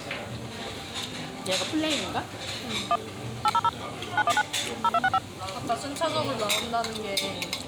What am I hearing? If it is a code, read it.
DTMF, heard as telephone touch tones, dialled by machine, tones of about 50 ms, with the noise of a restaurant. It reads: 1 800 919 0265